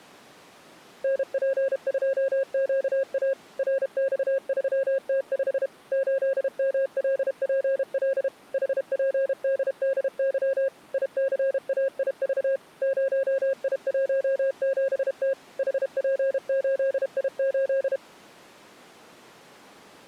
Morse code, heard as a keyed tone, machine-sent, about 32 wpm, 540 Hz. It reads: NP2QA RX3T5 8MLPL HPDDY ICAIV 0I17T HP8I8